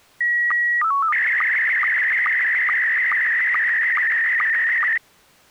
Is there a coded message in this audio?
Yes: SSTV (slow-scan television), Scottie S1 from 0.2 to 5.0 s, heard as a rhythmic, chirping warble.